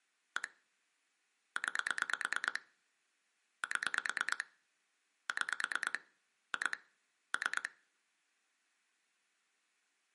Pulse dialling, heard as clicks on a phone line, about 9 pulses a second, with room echo. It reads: 1 9 7 6 2 3